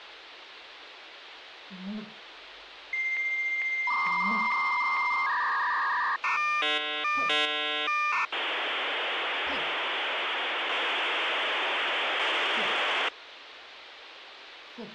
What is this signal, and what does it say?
Dial-up modem handshake (V.34 or later), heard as a whistle, warbles, then hiss, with phone line noise.